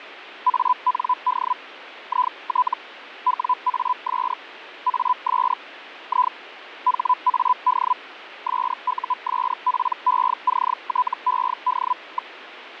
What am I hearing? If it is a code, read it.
Hellschreiber (Feld-Hell, 122.5 baud), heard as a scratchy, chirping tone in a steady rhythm, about 1000 Hz, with radio static. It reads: AND IT WAS AS I HAD SUSPECTED.